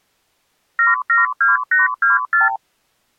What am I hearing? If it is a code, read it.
Multi-frequency trunk signalling (R2, with the far end's replies), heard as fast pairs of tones, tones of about 150 ms. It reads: 772824